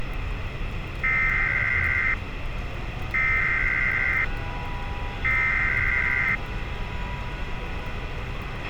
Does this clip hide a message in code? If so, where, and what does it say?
Yes: Emergency Alert System (SAME) tones (header bursts) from 1.0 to 6.4 s, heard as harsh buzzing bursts, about 520.83 baud, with radio hiss, a squelch burst at the end and street noise.